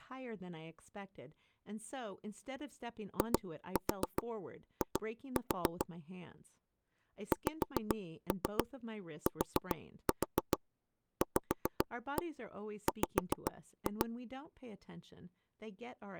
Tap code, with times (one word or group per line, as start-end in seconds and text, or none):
3.2-5.9 II
7.3-14.1 XTVW